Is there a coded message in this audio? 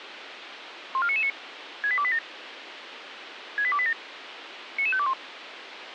Yes: five-tone selective call (ZVEI) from 0.9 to 5.1 s, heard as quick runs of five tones, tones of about 70 ms, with radio hiss. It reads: 14999 68287 68287 99521